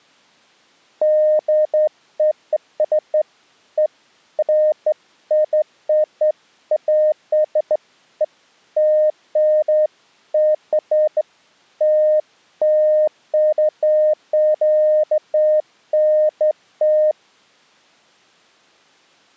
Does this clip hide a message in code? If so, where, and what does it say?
No, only beeps of irregular length.